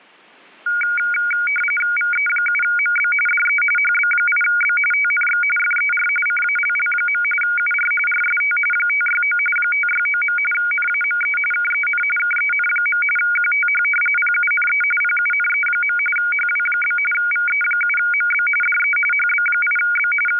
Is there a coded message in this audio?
Yes: RTTY (45.45 baud, 850 Hz shift) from 0.7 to 20.4 s, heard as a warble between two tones, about 1850 Hz centre. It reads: VE7MB DE HB8B TNX FER CALL. UR RST 569 569. NAME KEN KEN. QTH PUNE PUNE. HW? VE7MB DE HB8B …